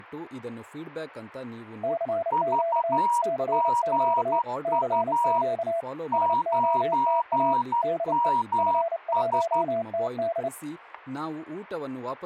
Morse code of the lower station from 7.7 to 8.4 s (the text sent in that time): DE